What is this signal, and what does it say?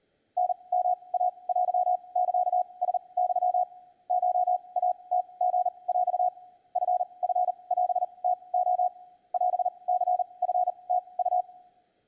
Morse code (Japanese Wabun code), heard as a keyed tone, machine-sent, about 39 wpm, spaced as for 27 wpm, 720 Hz. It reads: タヨイテサラユ コイムリヰ チチオムレ オニチムウ